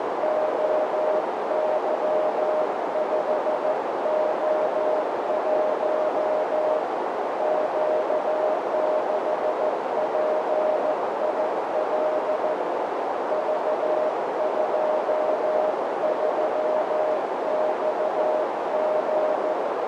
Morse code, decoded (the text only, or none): OY5O1 Q6PIL V23XG